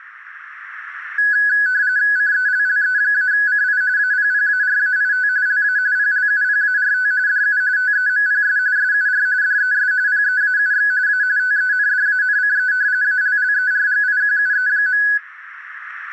RTTY (45.45 baud, 170 Hz shift), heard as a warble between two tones, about 1600 Hz centre, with radio static. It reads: CELLE-CI APPARAIT LA PLUPART DU TEMPS SUR DES PEAUX A TENDANCE ALLERGIQUE.